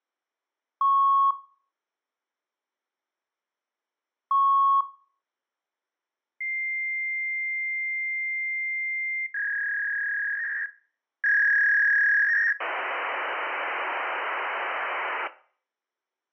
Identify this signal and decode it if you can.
Fax machine handshake, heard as beeps, a long tone, a warble and hiss, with room echo.